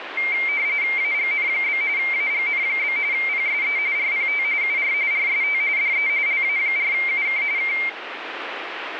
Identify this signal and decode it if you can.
RTTY (45.45 baud, 170 Hz shift), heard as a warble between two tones, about 2200 Hz centre, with radio static. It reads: AGN? AGN? PSE RPT UR RST DE LA4UK K